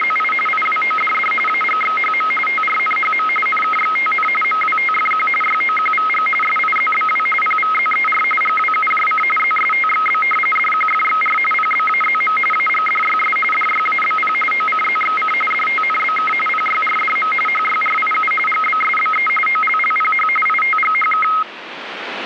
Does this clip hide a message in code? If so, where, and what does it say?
Yes: RTTY (45.45 baud, 850 Hz shift) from 0.0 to 21.4 s, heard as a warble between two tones, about 1700 Hz centre, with radio static. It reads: … IWODD AGXHM TRNHM NKXTN MWTFQ YOQVG SIZBW PVZER GWUJC ZSTXB DQFXR PBAZM AGDYS DYABP OCZXC DTNBK PYRDM HYRIU GBSBE OLLPH ITGHK